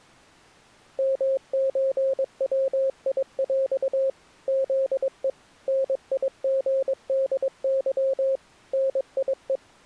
Morse code (with Polish letters), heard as a keyed tone, machine-sent, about 22 wpm, 540 Hz. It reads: MÓWIŁ ZE NIGDY NIE